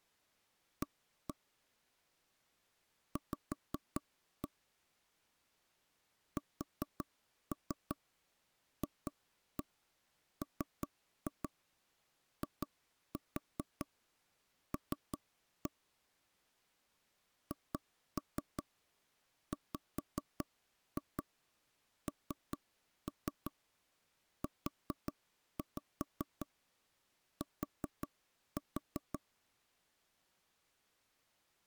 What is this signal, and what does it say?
Tap code, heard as knocks on wood, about 5 knocks a second. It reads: A V SFMIL HWNUT